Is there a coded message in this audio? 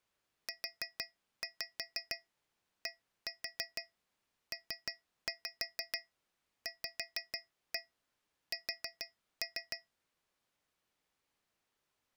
Yes: tap code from 0.5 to 9.9 s, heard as taps on a metal pipe, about 6 knocks a second. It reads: UDPVS